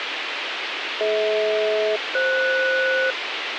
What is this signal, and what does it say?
Aircraft SELCAL, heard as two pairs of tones, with radio hiss. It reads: DH-FS